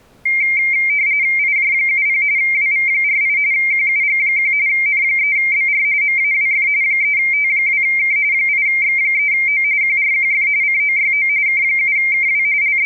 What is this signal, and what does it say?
RTTY (45.45 baud, 170 Hz shift), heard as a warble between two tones, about 2200 Hz centre. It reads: IJ70 WV48 QUG1 N3BR MAWF 3T2K 8X3O QRQF COYO K7KW …